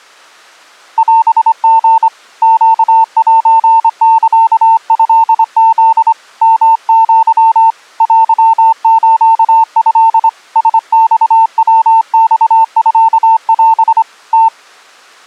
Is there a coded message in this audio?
Yes: Morse code (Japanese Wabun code) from 0.9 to 14.5 s, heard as a keyed tone, hand-sent with a straight key, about 25 wpm, 900 Hz. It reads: オリ ネセサトフ ヨア テスト ラマヤマミオ ム